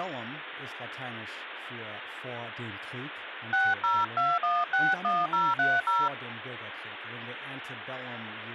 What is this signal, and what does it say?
DTMF, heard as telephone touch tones, dialled by hand, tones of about 210 ms, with phone line noise and speech in German. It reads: 602161030